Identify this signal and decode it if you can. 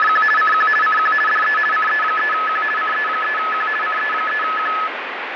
RTTY (50 baud, 450 Hz shift), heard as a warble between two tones, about 1500 Hz centre, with radio static. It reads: … CQ CQ DE CE3Q CE3Q CE3Q